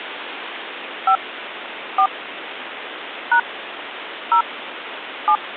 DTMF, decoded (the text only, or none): 5 4 # 0 7